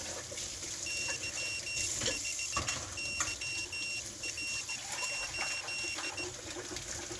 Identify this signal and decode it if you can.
Morse code, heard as a high beeper, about 17 wpm, 2750 Hz, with kitchen noise. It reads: Y5YR8